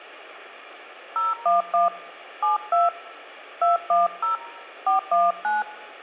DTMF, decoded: 011 72 210 419

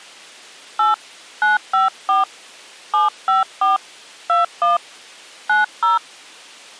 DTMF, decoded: 8 954 754 21 90

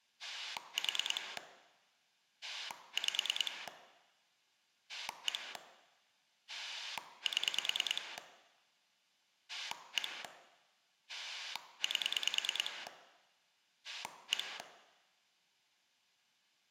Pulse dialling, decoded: 4 5 1 7 1 8 1

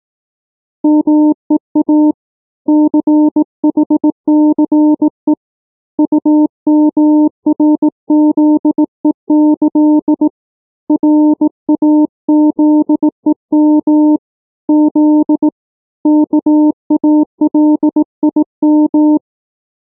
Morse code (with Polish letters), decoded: MEA CHCE UMRZEĆ RAZEM Z KALIM

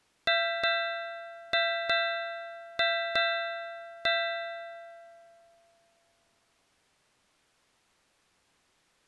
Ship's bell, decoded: 7

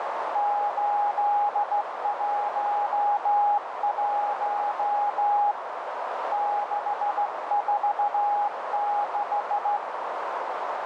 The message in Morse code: 811 646

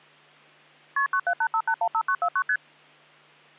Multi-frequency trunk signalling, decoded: KP 9785815949 ST

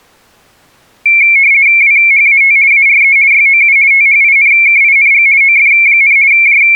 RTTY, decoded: WHAT ARE YOU THINKING OF, …

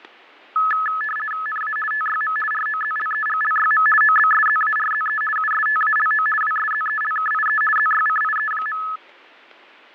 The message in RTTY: NA TYM ROZLEGLYM OBSZARZE USTALO WSZELKIE ZYCIE.

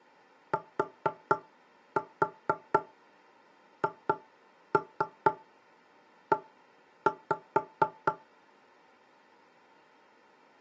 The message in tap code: THE

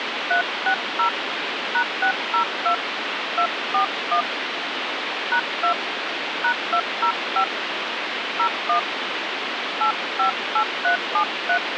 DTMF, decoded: 360 #602 241 #2 #205 01 858373

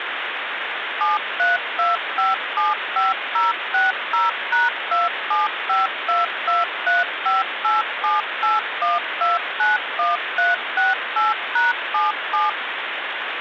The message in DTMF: 732575060#27522358781291368#77

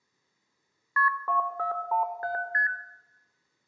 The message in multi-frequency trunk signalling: KP 2417 ST

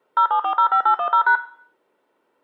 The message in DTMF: 07405810#

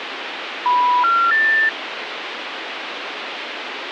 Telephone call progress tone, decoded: special information tone

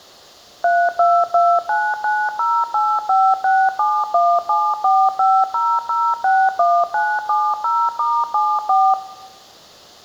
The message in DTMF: 322990856717450061970*74

